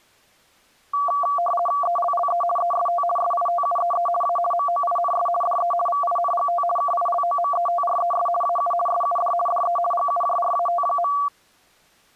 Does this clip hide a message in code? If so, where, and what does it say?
Yes: RTTY (50 baud, 450 Hz shift) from 0.9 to 11.3 s, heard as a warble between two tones, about 920 Hz centre. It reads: ELLE EST SITUEE A MOINS DE VINGT KILOMETRES AU SUD DE GUJRAT.